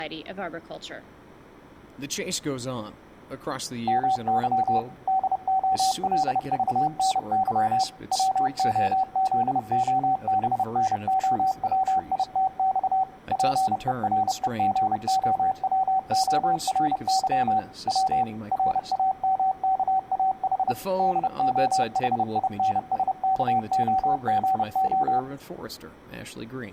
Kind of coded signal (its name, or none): Morse code